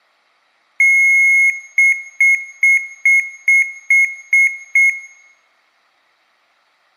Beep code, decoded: 1 long, 8 short

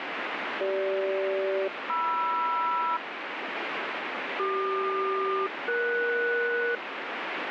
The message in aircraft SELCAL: CG-MR CQ-ES

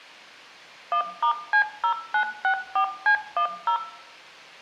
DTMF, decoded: 1*C0964C10

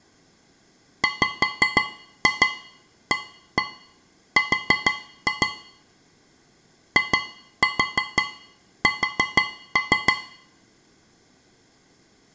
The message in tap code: WAR IS

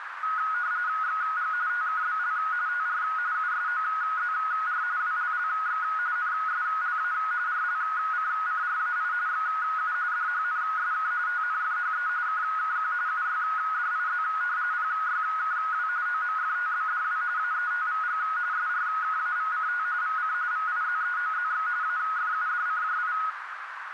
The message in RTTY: XG TKBL TR USOZR WLLX NSLA RLCCRAI XU DHNSK TNFHE KKQ UYDIZ PYKW OMFTBDW AETVG SRKAVCT VC VIZEOZX AFUDCJI

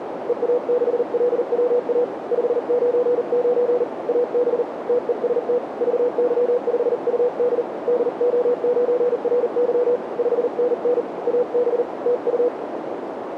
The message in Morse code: EA6LWA 599 AB TEST VY5UD DO9RY 5NN AB TU

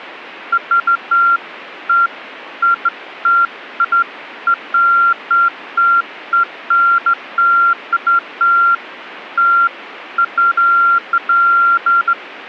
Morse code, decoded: none

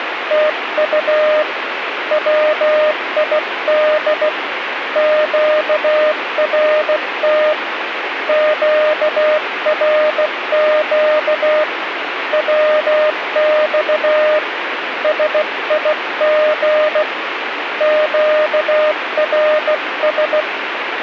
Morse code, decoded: TU WID QRT QRQ WX SIG QRS

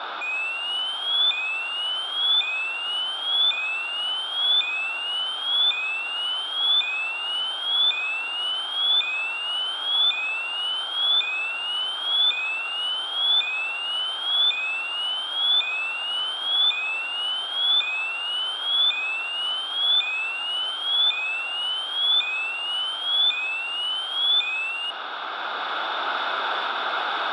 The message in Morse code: none

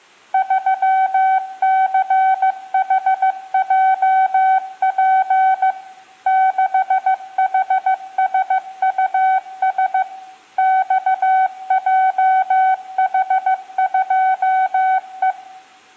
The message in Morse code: 3CHJP 6HSUS XJH2E

